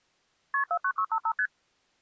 Multi-frequency trunk signalling (R1, as on North American trunks), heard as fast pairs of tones, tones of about 70 ms. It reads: KP 49655 ST